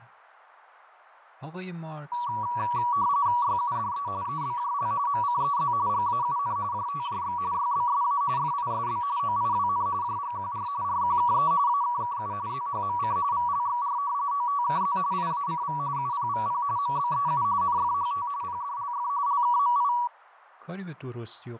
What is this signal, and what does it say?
RTTY (45.45 baud, 170 Hz shift), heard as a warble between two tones, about 1050 Hz centre, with fading and speech in Persian. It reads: YUDE EBJL MCEZ GAUN JTJX YBSA FISB OIWN JGQR RQKE AKKU ZHMC VLXR OTKZ IACV UPVP MBEU NFHT PDLF LKMI